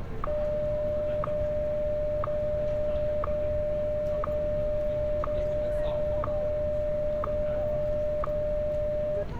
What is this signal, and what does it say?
Radio time signal (WWVH, Hawaii), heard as ticks, one a second, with street noise.